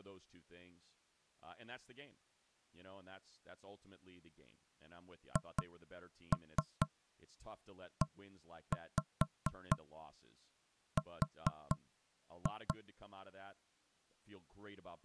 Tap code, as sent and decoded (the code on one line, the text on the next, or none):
2-3 1-5 4-2
HER